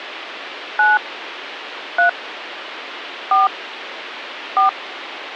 DTMF, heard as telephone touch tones, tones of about 160 ms, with phone line noise. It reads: 9 3 4 4